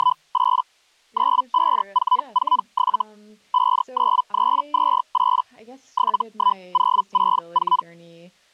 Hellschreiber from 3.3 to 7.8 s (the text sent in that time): 59328 71064